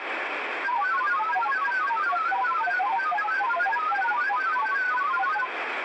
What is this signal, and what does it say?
Multi-tone FSK (Olivia or MFSK type), about 1000 Hz wide, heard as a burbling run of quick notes, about 31.25 baud, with radio static.